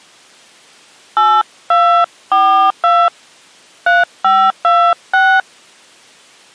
DTMF, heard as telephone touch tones, dialled by hand, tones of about 280 ms. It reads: 8242 3526